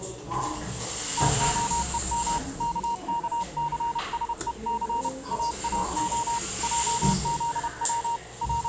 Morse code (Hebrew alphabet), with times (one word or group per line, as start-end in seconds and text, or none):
1.2-2.4 תהום
2.6-5.1 ככסשוס
5.3-6.4 אאה
6.6-8.2 עזץ
8.4-8.7 …